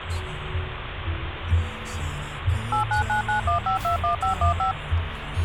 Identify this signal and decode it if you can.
DTMF, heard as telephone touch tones, dialled by machine, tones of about 120 ms, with phone line noise and the noise inside a car. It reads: 89991521515